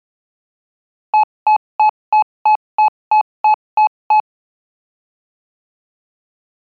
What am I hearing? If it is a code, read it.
Beep code, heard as beeps, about 860 Hz. 10 short. In AMI BIOS tables: CMOS shutdown register error.